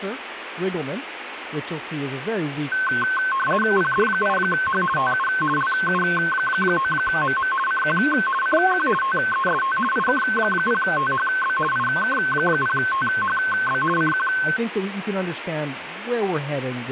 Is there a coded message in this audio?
Yes: RTTY (50 baud, 450 Hz shift) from 2.7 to 14.6 s, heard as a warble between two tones, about 1300 Hz centre, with radio static and speech in English. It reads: PD8H TU LU9MM CQ CQ TEST IK0THB IK0THB CQ